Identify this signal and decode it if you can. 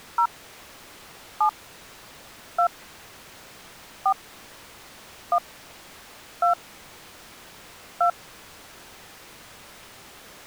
DTMF, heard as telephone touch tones, dialled by hand, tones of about 100 ms. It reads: 0 7 2 4 1 2 2